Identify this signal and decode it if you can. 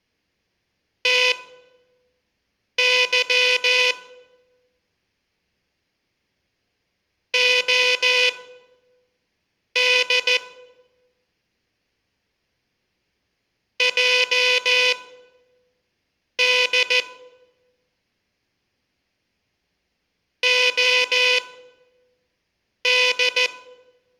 Morse code, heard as a buzzer, machine-sent, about 14 wpm, spaced as for 5 wpm. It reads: TY OD JD OD